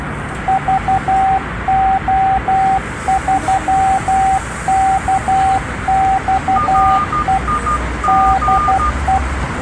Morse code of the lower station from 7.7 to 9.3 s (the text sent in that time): DE